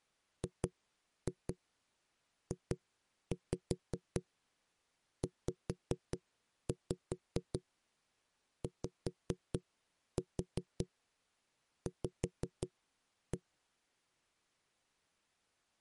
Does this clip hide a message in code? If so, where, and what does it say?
Yes: tap code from 0.4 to 13.4 s, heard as knocks on a wall, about 5 knocks a second. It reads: GJZYV